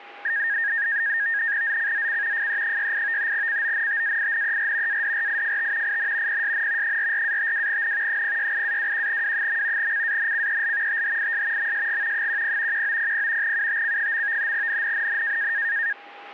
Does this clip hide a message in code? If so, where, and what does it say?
Yes: NAVTEX (SITOR-B), 100 baud, 170 Hz shift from 0.2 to 15.9 s, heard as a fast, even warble, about 1750 Hz centre, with radio static and a steady whistle near 810 Hz. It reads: ZCZC FE68 CONTAINER ADRIFT IN PSN 44-52N 068-21W. CANCEL THIS MSG 10 1900 UTC. NNNN